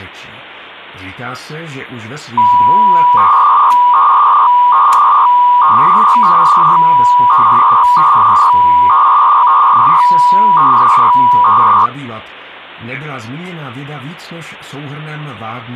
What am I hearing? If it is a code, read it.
300-baud modem data (V.21 tones), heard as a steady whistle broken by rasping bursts, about 300 baud, 200 Hz shift.